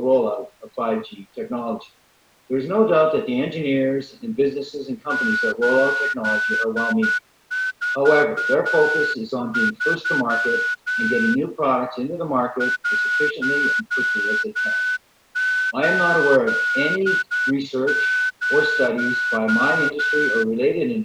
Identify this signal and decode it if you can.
Morse code, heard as a whistle, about 9 wpm. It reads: 843 180